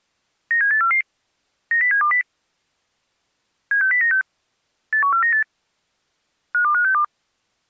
Five-tone selective call (CCIR), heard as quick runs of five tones, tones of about 100 ms. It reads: 97844 90720 76096 81498 52562